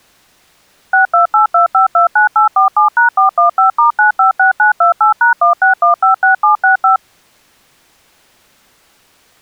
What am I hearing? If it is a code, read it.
DTMF, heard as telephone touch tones, dialled by machine, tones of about 120 ms. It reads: 6282529847#415*956928#16156765